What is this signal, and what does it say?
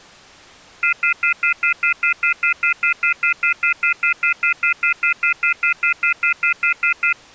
Telephone call progress tone (North American plan), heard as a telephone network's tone, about 1400, 2050, 2450, 2600 Hz, 0.1 s on and 0.1 s off. Off-hook warning tone.